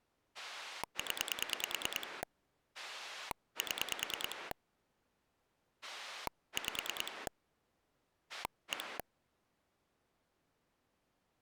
Pulse dialling, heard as a rotary dial, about 9 pulses a second. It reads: 0 7 5 1